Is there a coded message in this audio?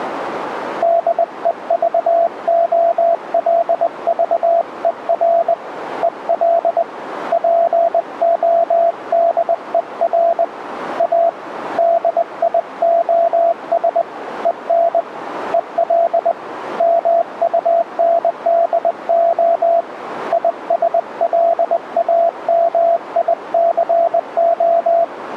Yes: Morse code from 0.8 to 25.1 s, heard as a keyed tone, hand-sent with a bug key, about 20 wpm, 680 Hz, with radio static. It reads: DEVOLVER EL PODER A DIOS EN EL MUNDO ISLAMICO